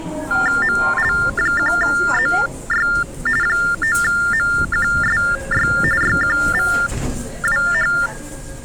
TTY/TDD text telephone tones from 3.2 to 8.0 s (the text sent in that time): 9MQSY YQVWH